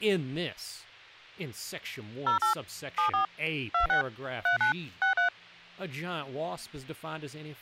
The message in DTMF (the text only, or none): 08 74 26 39 63